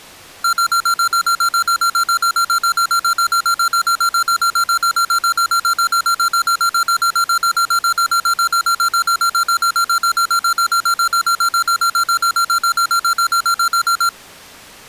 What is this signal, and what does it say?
Evenly repeated beeps. There is no code.